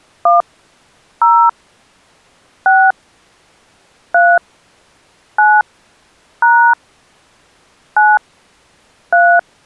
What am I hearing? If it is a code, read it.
DTMF, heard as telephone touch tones, dialled by hand, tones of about 230 ms. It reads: 1 0 6 3 9 # 9 3